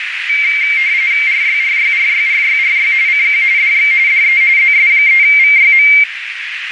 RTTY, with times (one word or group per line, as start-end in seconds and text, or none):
1.3-2.9 RYRYRYRYRY
3.1-3.4 CQ
3.6-3.9 DX
4.1-4.4 DE
4.6-5.9 ZS3VYM